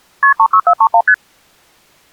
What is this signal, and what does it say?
Multi-frequency trunk signalling (R1, as on North American trunks), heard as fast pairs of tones, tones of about 70 ms. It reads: KP 36431 ST